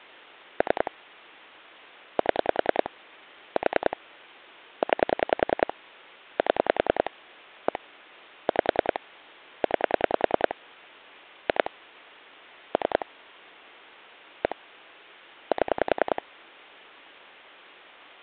Pulse dialling, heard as clicks on a phone line, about 10 pulses a second. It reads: 3 7 4 9 7 1 5 9 2 3 1 7